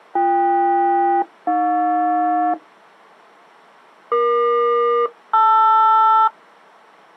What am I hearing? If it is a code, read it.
Aircraft SELCAL, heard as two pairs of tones. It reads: BK-AJ EQ-LR